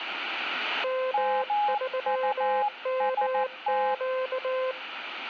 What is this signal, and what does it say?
Morse code, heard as two keyed tones. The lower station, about 19 wpm, 520 Hz: M3MQ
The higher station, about 14 wpm, 830 Hz: MUST